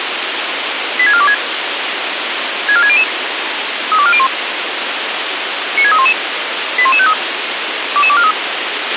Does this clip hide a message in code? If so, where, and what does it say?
Yes: five-tone selective call (ZVEI) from 1.0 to 8.3 s, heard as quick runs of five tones, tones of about 70 ms, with radio hiss and a squelch burst at the end. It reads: 86426 64600 32401 96311 81153 22243